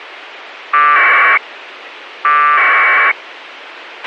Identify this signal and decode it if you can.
Packet radio (AX.25, as in APRS), 1200 baud, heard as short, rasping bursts, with radio hiss and a squelch burst at the end.